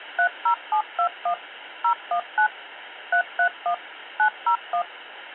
DTMF, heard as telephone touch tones, dialled by machine, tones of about 90 ms, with phone line noise. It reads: 30721 019 331 901